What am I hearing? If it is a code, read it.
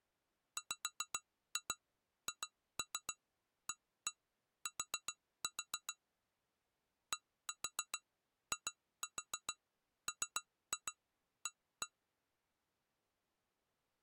Tap code, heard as taps on glass, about 7 knocks a second. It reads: WHAT DIMA